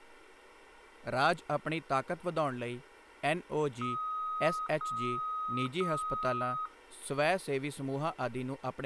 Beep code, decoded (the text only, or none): 3 long